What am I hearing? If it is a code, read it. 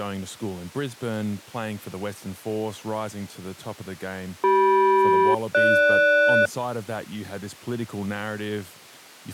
Aircraft SELCAL, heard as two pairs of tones, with speech in English. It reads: CM-GS